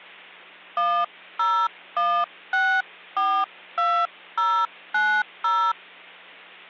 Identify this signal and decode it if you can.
DTMF, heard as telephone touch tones, dialled by hand, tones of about 280 ms, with hum. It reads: 101642090